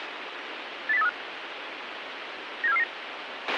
Five-tone selective call (EEA), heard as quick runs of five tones, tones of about 40 ms, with radio hiss and a squelch burst at the end. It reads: 80835 97449